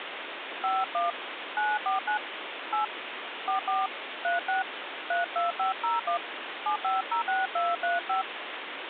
DTMF, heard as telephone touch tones, dialled by hand, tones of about 160 ms, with phone line noise. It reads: 51 949 8 44 36 32501 7506235